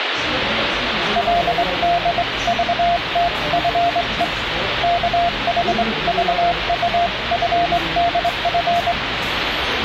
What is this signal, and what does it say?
Morse code (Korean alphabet), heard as a keyed tone, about 22 wpm, 690 Hz, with radio static and the noise of a restaurant. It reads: 그러나 우리는